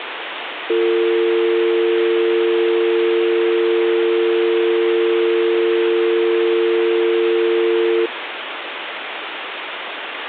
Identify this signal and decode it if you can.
Telephone call progress tone (North American or UK plan), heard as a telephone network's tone, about 350, 450 Hz, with phone line noise. Dial tone.